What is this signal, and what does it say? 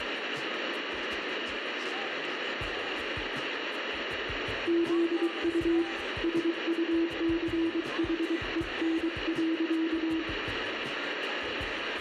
Morse code, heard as a keyed tone, hand-sent with a paddle, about 23 wpm, 330 Hz, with radio static and room echo. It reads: ZU SUCHEN.